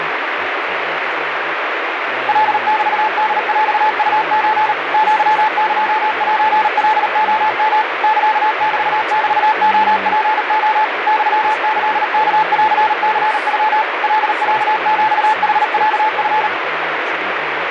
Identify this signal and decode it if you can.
Morse code (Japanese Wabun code), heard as a keyed tone, machine-sent, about 38 wpm, 870 Hz, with radio static and speech in English. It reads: カメホヰウソ アエセカレヨ サメメレツレ ユキワンニノ カロヒヌロチ